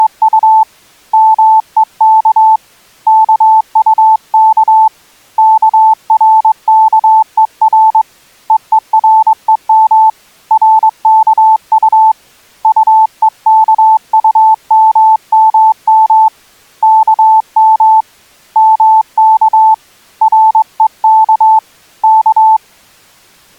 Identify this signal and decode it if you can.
Morse code, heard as a keyed tone, hand-sent with a straight key, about 22 wpm, 880 Hz. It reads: … MEK KUK KRKER EEREM RKU UEKUMMM KM MK REK K